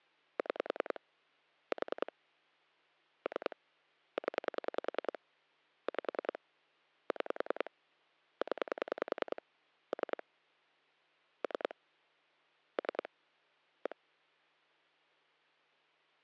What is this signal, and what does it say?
Pulse dialling, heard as clicks on a phone line, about 10 pulses a second. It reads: 6 4 3 0 5 6 0 3 3 3 1